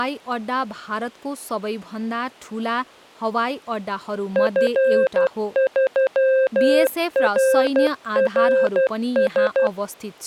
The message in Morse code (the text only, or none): F3RRS